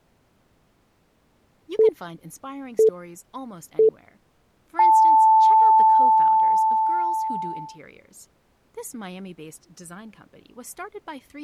Radio time signal (three low pips and a long one an octave up, as on NHK), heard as pips, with speech in English.